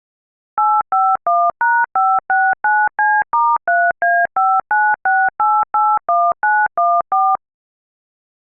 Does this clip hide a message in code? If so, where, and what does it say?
Yes: DTMF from 0.6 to 7.4 s, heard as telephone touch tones, dialled by machine, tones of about 230 ms. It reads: 851#569C*3A596881914